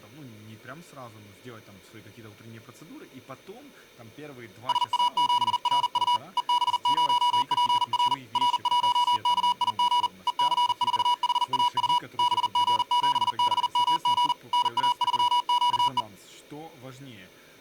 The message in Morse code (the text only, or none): SA7RU EB0PR R1KIG EC4HAU BG7BMG NA3QE